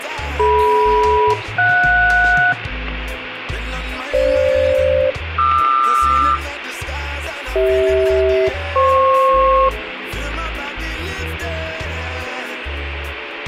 Aircraft SELCAL, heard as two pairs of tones, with radio static and room echo. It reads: DM-JS FG-QR CH-FP